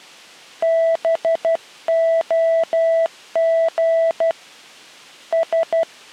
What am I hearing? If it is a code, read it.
Morse code (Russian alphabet), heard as a keyed tone, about 12 wpm, 660 Hz. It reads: БОГ С